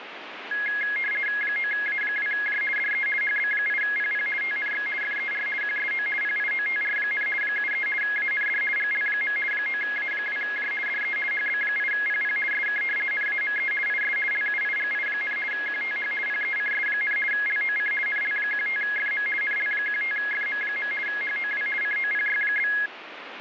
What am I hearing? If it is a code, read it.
RTTY (50 baud, 450 Hz shift), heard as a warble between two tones, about 1900 Hz centre, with radio static. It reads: 9A2J DE HB8PP TNX FER QSO PIOTR, 73 AND GL. 9A2J DE HB8PP SK NAME IS LUIGI, QTH PECS, LOC NL15FM NL15FM. HOW COPY?